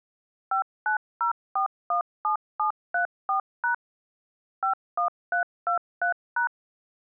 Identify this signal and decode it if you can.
DTMF, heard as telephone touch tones, dialled by machine, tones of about 110 ms. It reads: 590417734# 51323#